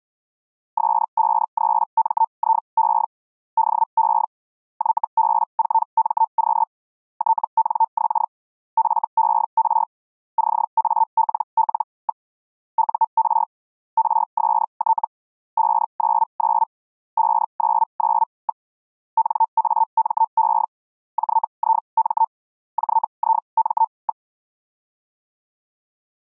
Hellschreiber (Feld-Hell, 122.5 baud), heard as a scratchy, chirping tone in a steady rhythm, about 900 Hz. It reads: S53MIE DE YB4MQ TNX FER CALL. UR RST 599 599. NAME JIM JIM.